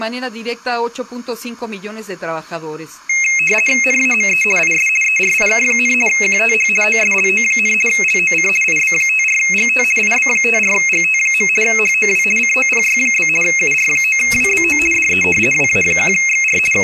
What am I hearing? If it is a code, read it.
RTTY (50 baud, 450 Hz shift), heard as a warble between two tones, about 2350 Hz centre. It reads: NAME IS ERIK, QTH OSLO, LOC IB54GT IB54GT. HOW COPY? UR9WBO DE WA1XR …